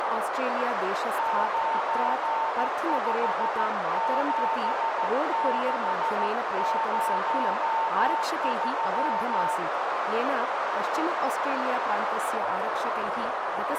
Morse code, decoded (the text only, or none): 957603